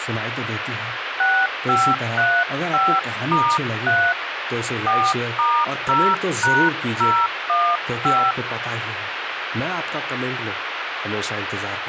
DTMF, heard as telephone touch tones, dialled by hand, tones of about 260 ms, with radio hiss, a squelch burst at the end and speech in Urdu. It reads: 6535*3 4*0#015